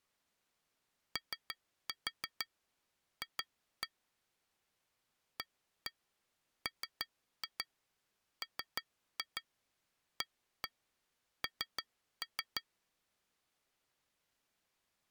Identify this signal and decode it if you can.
Tap code, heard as taps on glass, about 6 knocks a second. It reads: OF AMMAN